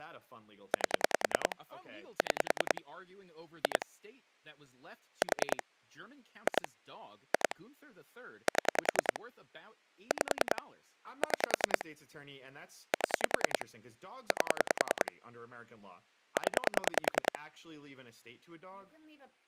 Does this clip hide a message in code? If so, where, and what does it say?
Yes: pulse dialling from 0.7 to 17.4 s, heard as clicks on a phone line, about 10 pulses a second, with speech in English. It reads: 8 6 2 4 2 2 7 5 6 7 8 0